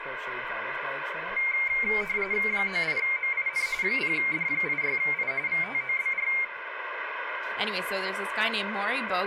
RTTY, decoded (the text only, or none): 98MIN 0D86I VTOBR